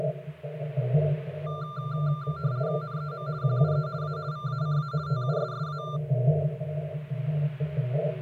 RTTY (50 baud, 170 Hz shift), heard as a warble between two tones, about 1280 Hz centre. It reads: NEM QUE A VACA TUSSA